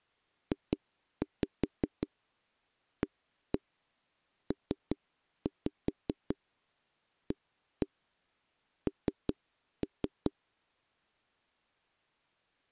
Tap code, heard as knocks on a wall, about 5 knocks a second. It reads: JAPAN